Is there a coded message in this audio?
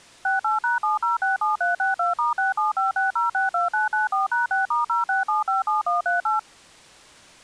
Yes: DTMF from 0.2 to 6.4 s, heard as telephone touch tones, dialled by machine, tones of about 150 ms. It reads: 68#7067362*6756062994#6*06757138